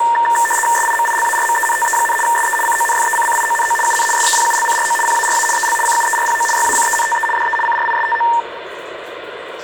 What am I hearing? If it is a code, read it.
RTTY (75 baud, 850 Hz shift), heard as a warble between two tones, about 1360 Hz centre, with radio static, room echo and the noise of a restroom. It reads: SIMILARMENTE, SE CONFECCIONO UN SEPULCRO PARA EL CUERPO YACENTE DE CRISTO